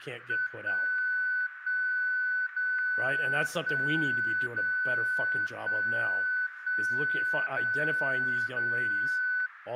Radio time signal (DCF77), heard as a tone whose level steps once a second, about 1500 Hz, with radio static and speech in English. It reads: 1 1 0 1 0 1 1 0 0